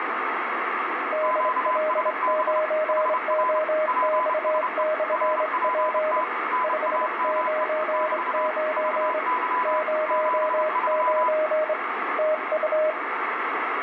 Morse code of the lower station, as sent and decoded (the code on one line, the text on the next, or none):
-.. .-.. ----. --- -..- -..-. .--. / ..... ----. ----. / ----- ----. / - ..-
DL9OX/P 599 09 TU